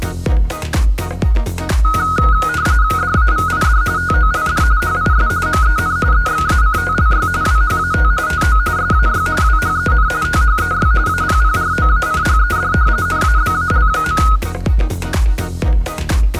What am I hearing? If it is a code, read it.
RTTY (45.45 baud, 170 Hz shift), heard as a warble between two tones, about 1360 Hz centre. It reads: DAVID TOLD HIS MEN EXACTLY WHAT TO SAY WHEN THEY APPROACHED NABAL.